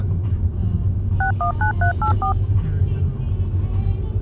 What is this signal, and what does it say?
DTMF, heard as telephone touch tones, dialled by machine, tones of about 100 ms, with the noise inside a car. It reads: 619384